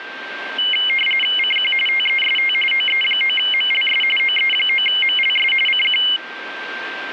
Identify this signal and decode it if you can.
RTTY (45.45 baud, 850 Hz shift), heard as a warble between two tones, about 2550 Hz centre, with radio static and a steady whistle near 1570 Hz. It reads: CQ TEST OE9MLS OE9MLS CQ